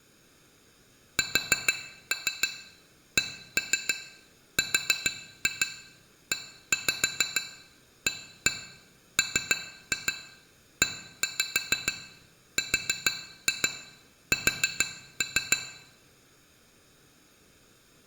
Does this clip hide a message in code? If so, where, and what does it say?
Yes: tap code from 1.2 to 15.6 s, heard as taps on glass, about 6 knocks a second, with room echo. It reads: SCREAMERS